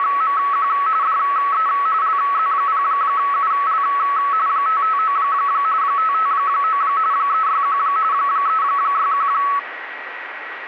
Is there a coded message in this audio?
Yes: RTTY (45.45 baud, 170 Hz shift) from 0.0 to 9.6 s, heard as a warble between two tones, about 1210 Hz centre, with radio static and a steady whistle near 1920 Hz. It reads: … DE LZ0UL 559 559 361 361